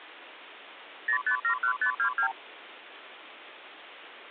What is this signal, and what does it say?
Multi-frequency trunk signalling (R2, with the far end's replies), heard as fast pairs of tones, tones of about 90 ms, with phone line noise. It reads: 0571522